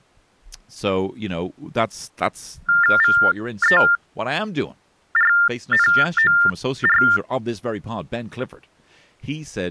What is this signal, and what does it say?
TTY/TDD text telephone tones (45.45 baud Baudot), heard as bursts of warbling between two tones, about 400 Hz shift, 1600 Hz centre, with speech in English. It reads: VERNOR